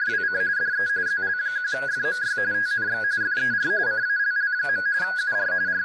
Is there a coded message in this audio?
Yes: RTTY (45.45 baud, 170 Hz shift) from 0.0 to 5.8 s, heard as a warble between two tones, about 1550 Hz centre, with speech in English. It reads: … DE ZL1FMY TNX FER CALL. UR …